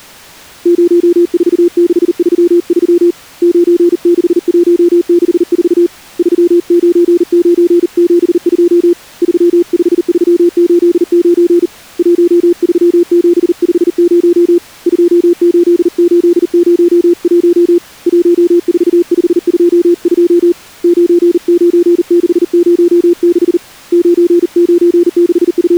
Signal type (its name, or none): Morse code